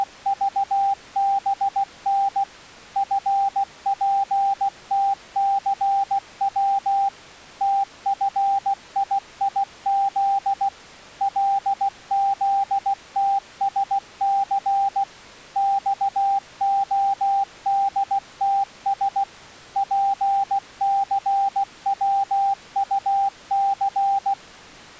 Morse code, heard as a keyed tone, machine-sent, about 16 wpm, 790 Hz. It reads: … FPTCW TFIIZ LZTSC XODTS PCWUC